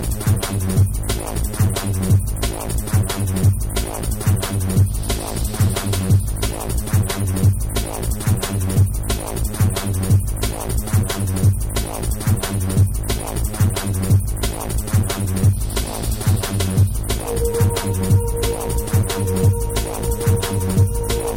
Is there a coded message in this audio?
No.